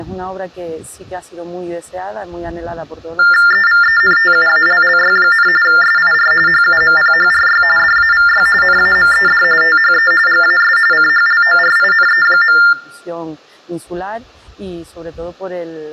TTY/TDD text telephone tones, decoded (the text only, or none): EVENTUALLY, SIR HUMPHRY DAVY NAMED THE GAS CHLORINE.